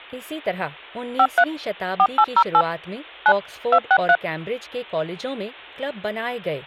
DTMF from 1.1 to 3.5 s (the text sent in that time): 53 4808 9